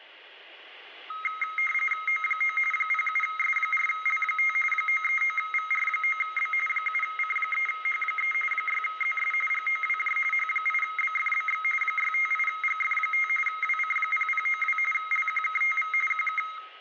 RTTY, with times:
2.1-2.6 O9
2.7-4.6 07S4L5
4.7-6.5 939VR9B
6.7-8.3 7C3H3
8.5-9.3 6ZS
9.5-10.2 GOWJ
10.3-11.6 H8BFBX
11.8-13.3 658GF5
13.5-14.8 WC0092
14.9-15.9 LQKTV
16.1-16.4 QK

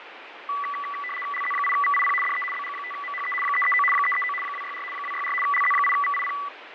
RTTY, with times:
1.3-2.1 LZ8VIP
2.2-2.4 DE
2.5-3.3 BG5MHE
3.4-3.8 339
3.9-4.3 339
4.4-4.8 264
4.9-5.3 264
5.4-6.3 LZ8VIP

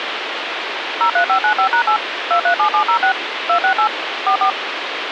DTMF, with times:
1.0-2.0 03595#8
2.3-3.1 237706
3.5-3.9 268
4.3-4.5 44

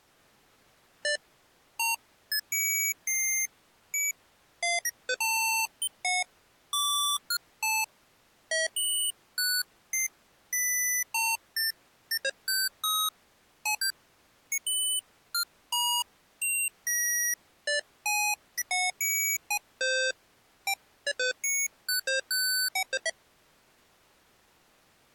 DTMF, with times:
none

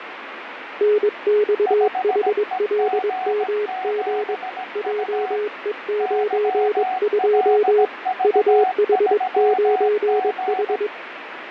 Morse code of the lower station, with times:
0.8-4.3 NXHLMG
4.8-7.8 JE92
8.2-10.9 UH9H

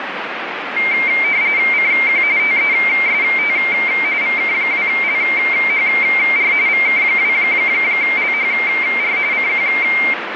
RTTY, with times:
1.7-2.2 CQ
2.4-3.6 TEST
4.2-6.5 VK2LHR
6.7-9.2 VK2LHR
9.3-9.7 CQ

